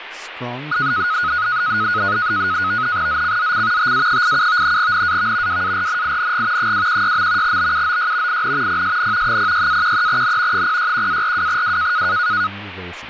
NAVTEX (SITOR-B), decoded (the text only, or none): ZCZC TA87 NAV WARNING 216. BUOY IN PSN 06-13N 061-42W